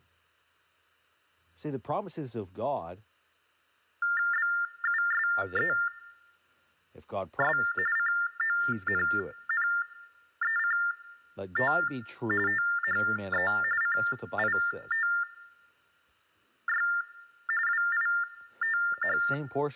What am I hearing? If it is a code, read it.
TTY/TDD text telephone tones (45.45 baud Baudot), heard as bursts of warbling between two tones, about 400 Hz shift, 1600 Hz centre, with speech in English. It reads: BUSES CONNECT THE CITY WITH